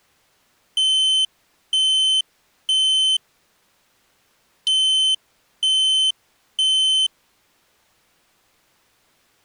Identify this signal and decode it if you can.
Alarm pattern, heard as an alarm's beeps, played twice, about 3050 Hz. Temporal three. Smoke or fire, evacuate.